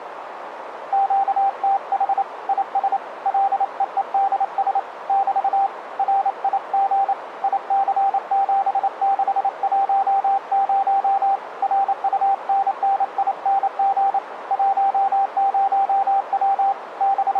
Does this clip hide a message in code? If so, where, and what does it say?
Yes: Morse code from 0.9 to 17.4 s, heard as a keyed tone, hand-sent with a paddle, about 28 wpm, 790 Hz, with radio static and a narrow filter. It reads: QTH IS LEEDS <BT> RIG IC7610 RUNNING 10W …